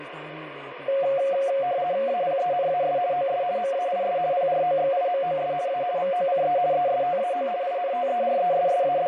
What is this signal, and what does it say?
RTTY (50 baud, 170 Hz shift), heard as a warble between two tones, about 630 Hz centre, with radio static. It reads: APENAS OS MAIS PROXIMOS A VOCE ESTAO …